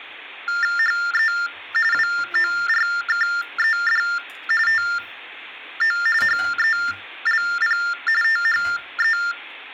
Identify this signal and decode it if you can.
TTY/TDD text telephone tones (45.45 baud Baudot), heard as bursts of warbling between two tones, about 400 Hz shift, 1600 Hz centre, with kitchen noise. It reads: HE WORKED TO HELP THE